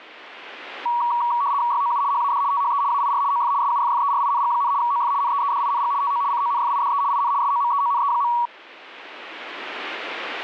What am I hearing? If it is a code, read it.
RTTY (75 baud, 170 Hz shift), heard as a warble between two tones, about 1040 Hz centre. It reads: YOU HAD THE AIR OF SUFFERING, OF NEEDING TO CONFIDE IN SOMEONE.